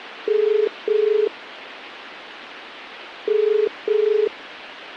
Telephone call progress tone (as in the UK, Ireland, Australia and similar networks), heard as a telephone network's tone, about 430 Hz, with phone line noise. Ringback tone.